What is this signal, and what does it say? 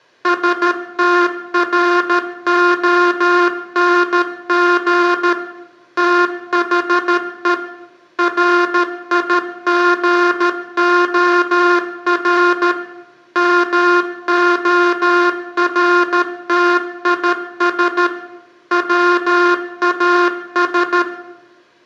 Morse code, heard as a buzzer, machine-sent, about 13 wpm, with room echo. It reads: STRONG THE RIGOR MORTIS WAS